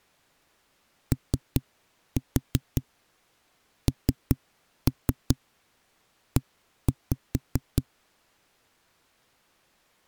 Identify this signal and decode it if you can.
Tap code, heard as knocks on a wall, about 5 knocks a second. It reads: ONE